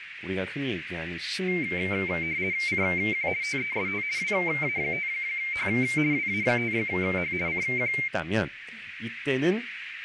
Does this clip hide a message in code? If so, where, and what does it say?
Yes: RTTY (50 baud, 170 Hz shift) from 1.5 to 8.1 s, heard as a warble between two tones, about 2200 Hz centre, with radio static, a narrow filter and speech in Korean. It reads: CQ TEST WA5H WA5H CQ